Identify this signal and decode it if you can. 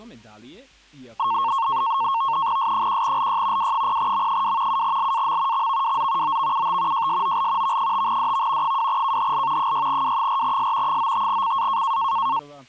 NAVTEX (SITOR-B), 100 baud, 170 Hz shift, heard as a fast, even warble, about 1000 Hz centre. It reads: S1LY W0M2 7LAM XVWZ OVUT JSOL V5DV 2KHL 6W4S 95CA